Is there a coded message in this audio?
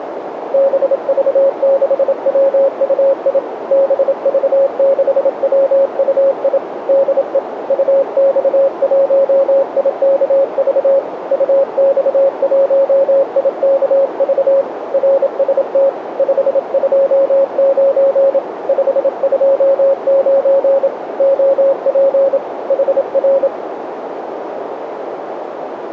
Yes: Morse code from 0.5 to 23.5 s, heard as a keyed tone, hand-sent with a paddle, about 27 wpm, 550 Hz, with radio static and a narrow filter. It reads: BV6WUI BV6WUI DE UX1IKV UX1IKV RST 529 529 OP HR